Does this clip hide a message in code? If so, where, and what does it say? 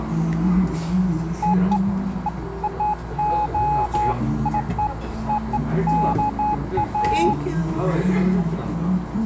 No, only beeps of irregular length, with radio static and the noise of a restaurant.